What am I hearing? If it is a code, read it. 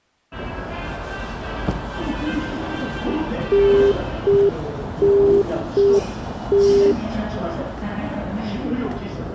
Telephone call progress tone (UK plan), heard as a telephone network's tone, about 400 Hz, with the noise of a subway station. Congestion tone.